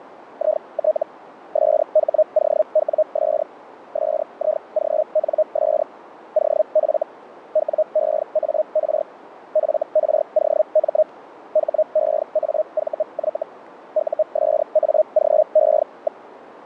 Hellschreiber (Feld-Hell, 122.5 baud), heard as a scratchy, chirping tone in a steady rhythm, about 620 Hz, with radio static. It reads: IT SHOWS SIGNS OF WEAR FROM HEAVY USAGE.